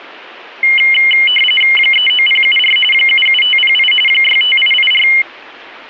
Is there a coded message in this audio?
Yes: RTTY (45.45 baud, 850 Hz shift) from 0.6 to 5.2 s, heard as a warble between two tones, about 2550 Hz centre, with static crashes. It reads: 39074 77508 65884